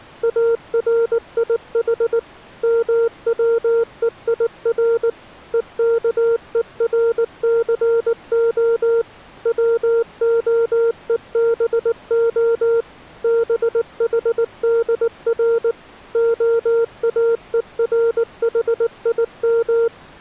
Morse code (Hebrew alphabet), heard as a keyed tone, machine-sent, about 19 wpm, 460 Hz. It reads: אריח מצויר וכורסה צהובה בחדר האורחים